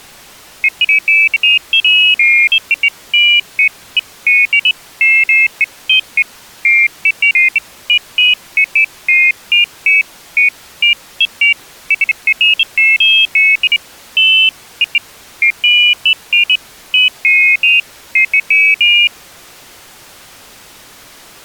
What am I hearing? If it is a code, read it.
Pairs of high tones at irregular times. There is no code.